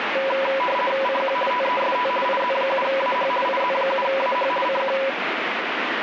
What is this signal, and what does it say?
RTTY (50 baud, 450 Hz shift), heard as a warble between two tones, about 760 Hz centre, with radio static. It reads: CQ TEST IZ7AH IZ7AH CQ